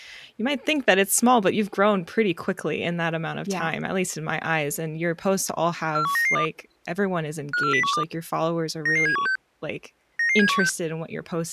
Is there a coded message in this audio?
Yes: five-tone selective call (CCIR) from 6.0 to 10.7 s, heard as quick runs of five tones, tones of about 100 ms, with speech in English. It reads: 41992 54012 99716 99716